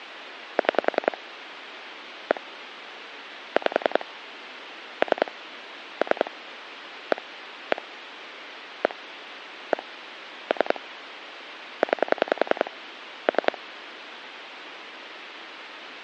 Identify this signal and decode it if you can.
Pulse dialling, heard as clicks on a phone line, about 10 pulses a second, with phone line noise. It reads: 6 1 5 3 3 1 1 1 1 3 9 3